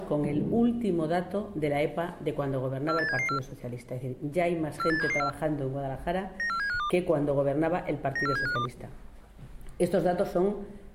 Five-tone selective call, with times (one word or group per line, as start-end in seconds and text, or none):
2.9-3.4 48774
4.8-5.3 48774
6.4-6.9 94752
8.2-8.7 94752